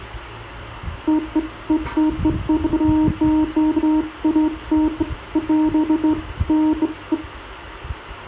Beeps of irregular length, with the noise of a residential street. There is no code.